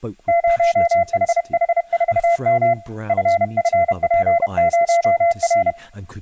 Morse code, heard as a keyed tone, hand-sent with a paddle, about 31 wpm, 680 Hz, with speech in English. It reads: 0HH4M FFP0R